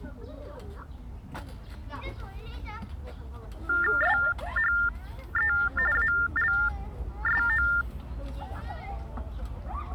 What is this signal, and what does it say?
TTY/TDD text telephone tones (45.45 baud Baudot), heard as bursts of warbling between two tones, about 400 Hz shift, 1600 Hz centre, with the noise of a park. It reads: SHE ALSO